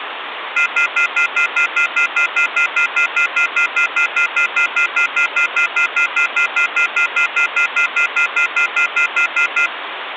Telephone call progress tone (North American plan), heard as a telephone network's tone, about 1400, 2050, 2450, 2600 Hz, 0.1 s on and 0.1 s off, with phone line noise. Off-hook warning tone.